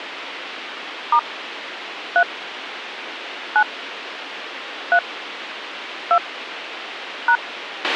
DTMF, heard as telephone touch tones, dialled by hand, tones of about 70 ms, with radio hiss and a squelch burst at the end. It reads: * 3 9 3 2 #